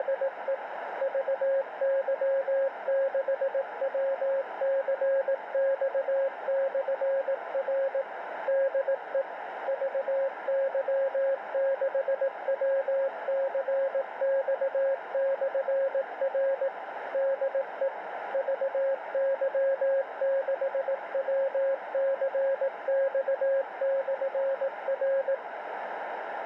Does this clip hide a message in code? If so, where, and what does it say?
Yes: Morse code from 0.0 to 25.4 s, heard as a keyed tone, machine-sent, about 18 wpm, 540 Hz, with radio static and a narrow filter. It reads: … VY6WCX/R DE VY6WCX/R DE VY6WCX/R